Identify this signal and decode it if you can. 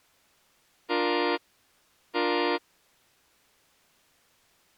Train horn signal, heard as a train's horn. 2 short. On North American railways: a signal is acknowledged.